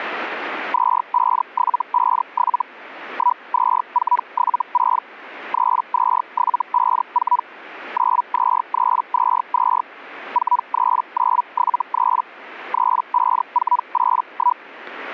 Hellschreiber (Feld-Hell, 122.5 baud), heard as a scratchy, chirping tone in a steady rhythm, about 980 Hz, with static crashes. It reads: 25757 12476 32754 92322 43973 35481